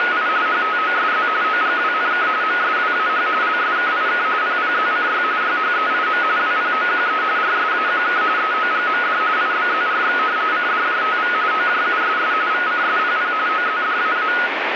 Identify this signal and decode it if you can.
RTTY (45.45 baud, 170 Hz shift), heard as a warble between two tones, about 1360 Hz centre, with radio static. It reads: … HTOSZ OGWNK MSWAH LSKIK PPZCY YHEIM WPOQE RSAQK EOGMD IBZRX CDJTV OJUSS VCSPP OZDAA